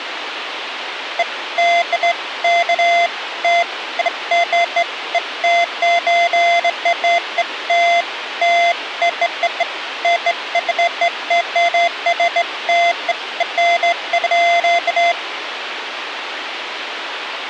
Beeps of irregular length, with radio hiss. There is no code.